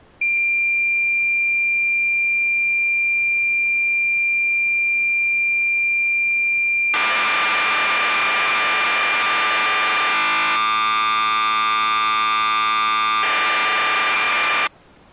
Cassette data (Kansas City type), 1200 baud, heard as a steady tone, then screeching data.